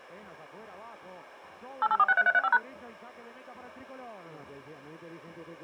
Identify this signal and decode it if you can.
DTMF, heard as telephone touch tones, dialled by machine, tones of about 40 ms. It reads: 88463335#